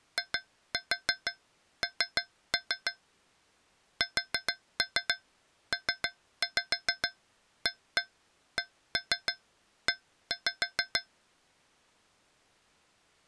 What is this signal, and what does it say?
Tap code, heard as taps on a metal pipe, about 6 knocks a second. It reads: IN SPACE